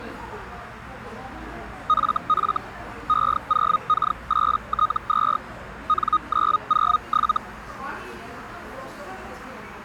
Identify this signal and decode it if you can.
Hellschreiber (Feld-Hell, 122.5 baud), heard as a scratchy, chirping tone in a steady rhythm, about 1240 Hz, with radio static and the noise of a crowd indoors. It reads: FF E0K8T2 N907